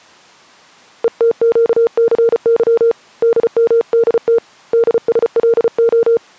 Morse code, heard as a keyed tone, hand-sent with a paddle, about 34 wpm, 460 Hz. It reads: ETQCY DMDT DSLO